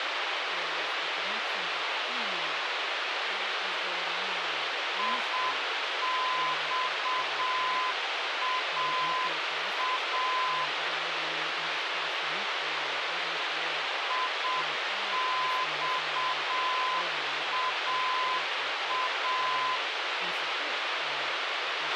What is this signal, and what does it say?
Morse code, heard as a keyed tone, machine-sent, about 7 wpm, 1020 Hz, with radio hiss, a squelch burst at the end and speech in English. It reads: IXAA IXAA